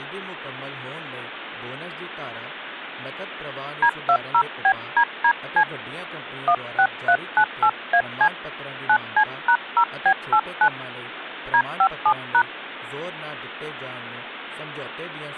DTMF, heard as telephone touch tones, dialled by hand, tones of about 70 ms, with phone line noise and speech in Punjabi. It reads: D20BDDC 16398AC 9C#0B89 D57#